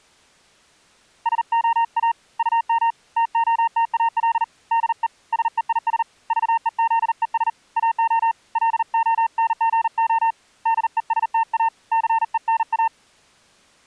Morse code, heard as a keyed tone, hand-sent with a paddle, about 39 wpm, 910 Hz. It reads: SOA UM TOTAL DE SEIS VEZES AO LONGO DESTA CENA